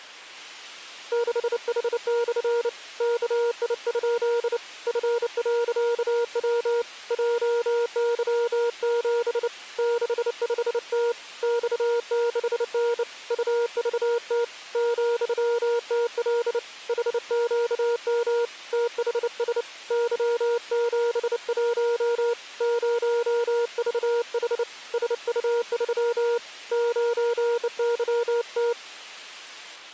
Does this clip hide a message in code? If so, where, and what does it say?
Yes: Morse code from 1.1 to 28.8 s, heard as a keyed tone, hand-sent with a bug key, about 29 wpm, 470 Hz. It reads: 6H/ KI? F.W JY7 65T X6N UVT ,TL HQM THS Y71 0VH SU3 9YT